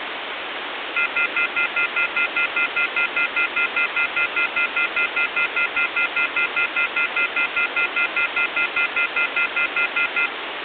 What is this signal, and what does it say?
Telephone call progress tone (North American plan), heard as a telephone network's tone, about 1400, 2050, 2450, 2600 Hz, 0.1 s on and 0.1 s off, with phone line noise. Off-hook warning tone.